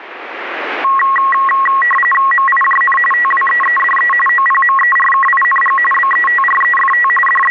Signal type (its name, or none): RTTY